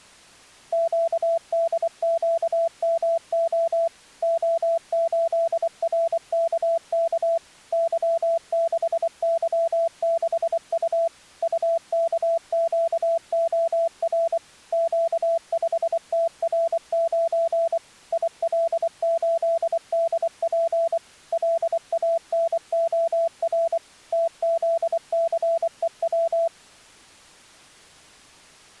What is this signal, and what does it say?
Morse code, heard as a keyed tone, machine-sent, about 24 wpm, 670 Hz. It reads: QDQMO O8RKK Y6Y6U UKQOR Q5TR9 IL8DP LANOR TZCEW